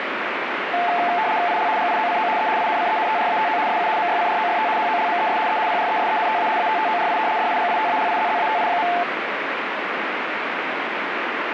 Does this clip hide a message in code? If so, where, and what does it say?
Yes: RTTY (75 baud, 170 Hz shift) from 0.7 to 9.0 s, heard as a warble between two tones, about 790 Hz centre, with radio static. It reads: IL GIOCO E INCENTRATO SU MYCROFT HOLMES E PRESENTA ATTORI DIGITALIZZATI.